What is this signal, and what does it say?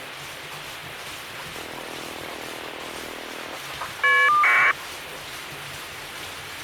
Caller ID data burst, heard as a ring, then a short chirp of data, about 1200 baud, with phone line noise and kitchen noise.